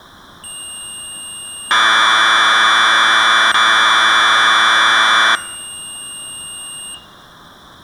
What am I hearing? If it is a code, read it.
Commodore tape loading (standard loader), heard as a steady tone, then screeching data.